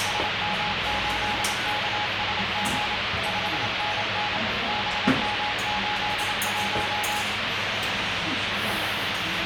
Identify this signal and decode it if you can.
Morse code, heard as a keyed tone, machine-sent, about 27 wpm, 840 Hz, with heavy radio static and the noise of a restaurant. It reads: SM8KSG 5NN BM81